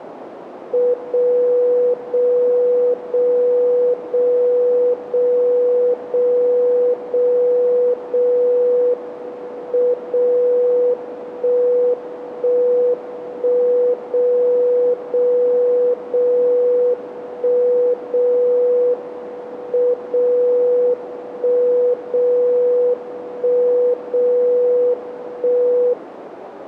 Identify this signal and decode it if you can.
Radio time signal (WWVB), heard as a tone whose level steps once a second, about 490 Hz, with radio static and a narrow filter. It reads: 0 0 0 0 0 0 0 0 M 0 1 1 1 0 0 0 1 0 M 0 1 0 1 0 1